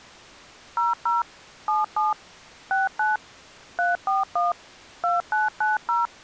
DTMF, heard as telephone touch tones, dialled by machine, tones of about 160 ms. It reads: 00 77 69 341 2990